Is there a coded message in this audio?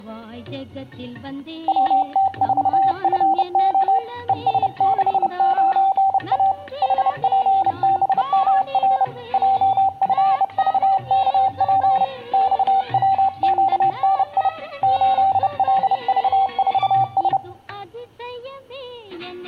Yes: Morse code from 1.6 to 17.4 s, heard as a keyed tone, hand-sent with a bug key, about 30 wpm, 780 Hz, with room echo. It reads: WT4FO ES69A HPBMR JFVKP XWQNI 8LV4S